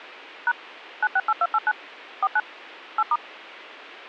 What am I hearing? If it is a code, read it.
DTMF, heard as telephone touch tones, dialled by machine, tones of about 50 ms. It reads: # 968289 49 8*